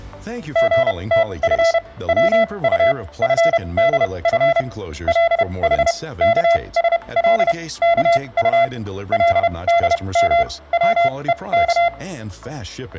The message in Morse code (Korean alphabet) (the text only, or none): 선비는 구역이 금방